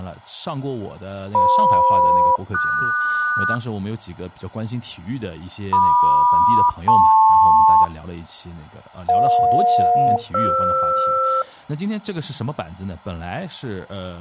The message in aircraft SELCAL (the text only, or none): FM-QS MQ-LP EJ-FR